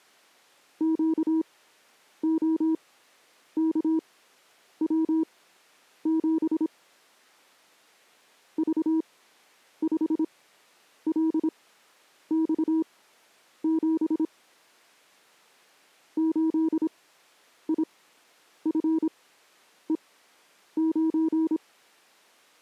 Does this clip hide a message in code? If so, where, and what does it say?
Yes: Morse code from 0.7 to 21.6 s, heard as a keyed tone, machine-sent, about 26 wpm, spaced as for 9 wpm, 320 Hz. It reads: QOKW7 V5LX7 8IFE9